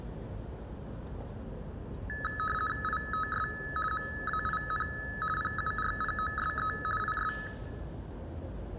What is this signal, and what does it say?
RTTY (50 baud, 450 Hz shift), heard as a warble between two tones, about 1500 Hz centre, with the noise of a residential street. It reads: ITS MAIN PURPOSE IS